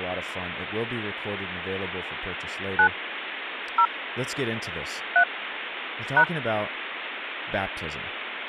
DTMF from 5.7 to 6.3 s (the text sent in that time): #